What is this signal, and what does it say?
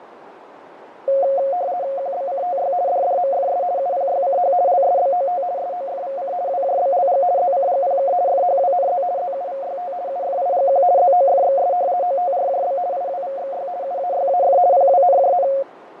RTTY (50 baud, 170 Hz shift), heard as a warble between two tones, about 630 Hz centre, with radio static, fading and a narrow filter. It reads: QBCTY DDMFS UPYCH LSBOT SOFVC WJBLG ZCGPK FHWNZ ZUVYT UFIGQ ZOFXS OTRJB IWVXY UAYAF PWNJN